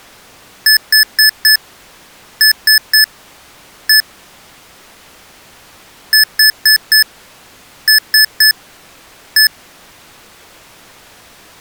Beep code, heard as beeps from a small speaker, played twice, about 1750 Hz. 4-3-1. In Phoenix BIOS tables: memory failure above the first 64 KB.